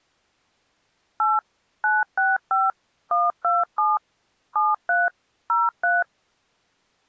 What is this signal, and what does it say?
DTMF, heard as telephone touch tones, dialled by machine, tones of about 190 ms. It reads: 8 965 127 73 03